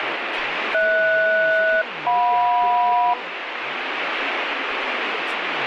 Aircraft SELCAL, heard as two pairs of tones, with radio static and speech in Bangla. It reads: HS-JM